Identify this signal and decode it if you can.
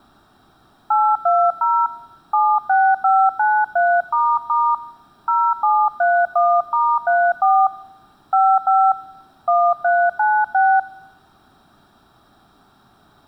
DTMF, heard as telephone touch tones, dialled by hand, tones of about 250 ms. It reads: 820 76593** 0731*34 55 1396